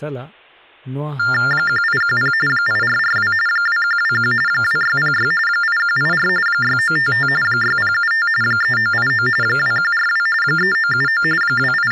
TTY/TDD text telephone tones (45.45 baud Baudot), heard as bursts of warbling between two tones, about 400 Hz shift, 1600 Hz centre, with speech in Santali. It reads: 1810 8442 2121 2606 8184 6955 6075 3989 2142 3979 …